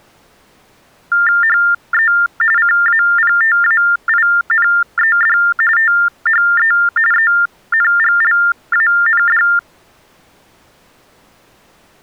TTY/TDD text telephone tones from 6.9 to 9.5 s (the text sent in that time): ENGLAND